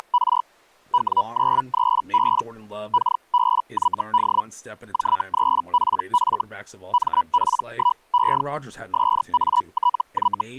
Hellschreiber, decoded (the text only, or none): … W93B KBYD J3PF MP1E SATY